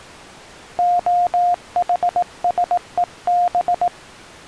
Morse code (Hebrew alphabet), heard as a keyed tone, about 18 wpm, 710 Hz. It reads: החשוב